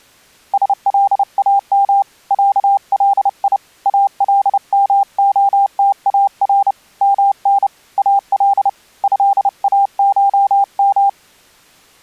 Morse code (Arabic alphabet), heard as a keyed tone, hand-sent with a paddle, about 30 wpm, 800 Hz. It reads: سلام علي المختار من ال هاشم